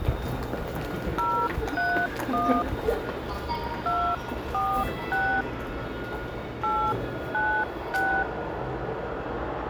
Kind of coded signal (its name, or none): DTMF